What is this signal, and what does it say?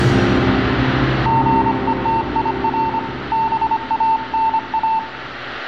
Morse code, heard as a keyed tone, hand-sent with a paddle, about 25 wpm, 900 Hz, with room echo. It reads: GETIR BANA